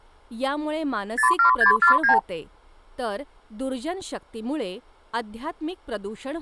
Multi-frequency trunk signalling (R2, with the far end's replies), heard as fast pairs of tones, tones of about 110 ms, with speech in Marathi. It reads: 07649